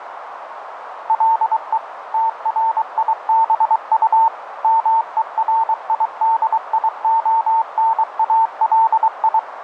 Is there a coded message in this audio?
Yes: Morse code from 1.0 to 9.5 s, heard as a keyed tone, machine-sent, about 23 wpm, 900 Hz, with radio static and a narrow filter. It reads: LE TRIBU MERIDIONALI